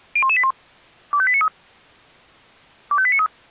Five-tone selective call (ZVEI), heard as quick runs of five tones, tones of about 70 ms. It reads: 01181 25893 25893